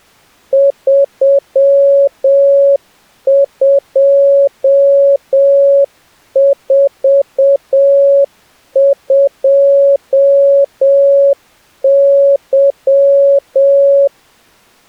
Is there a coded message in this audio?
Yes: Morse code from 0.5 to 14.1 s, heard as a keyed tone, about 7 wpm, 560 Hz. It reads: 3242Y